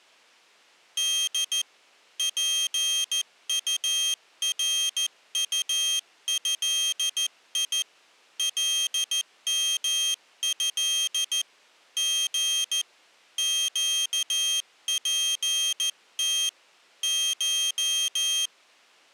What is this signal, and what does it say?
Morse code (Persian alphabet), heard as a high beeper, hand-sent with a paddle, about 14 wpm, 3200 Hz. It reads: د پطرطضی لمض ژ گپت ش